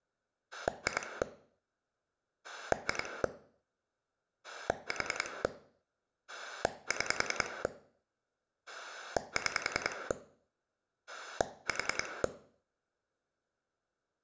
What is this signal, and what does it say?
Pulse dialling, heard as a rotary dial, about 10 pulses a second, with room echo. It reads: 2 2 4 6 6 4